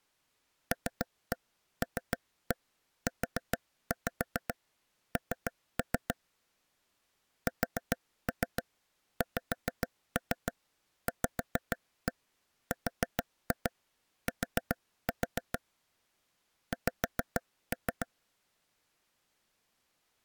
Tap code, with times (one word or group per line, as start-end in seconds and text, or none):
0.7-6.1 LLUN
7.5-15.6 SXVRT
16.7-18.1 X